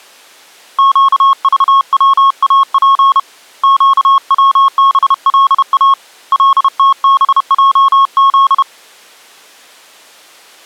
Morse code, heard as a keyed tone, hand-sent with a paddle, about 31 wpm, 1090 Hz. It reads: QVWAP QWBLA LTBJZ